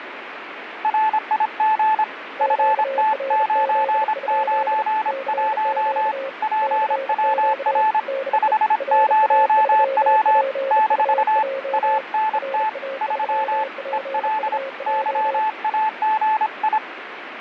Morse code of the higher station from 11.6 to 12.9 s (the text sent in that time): ANT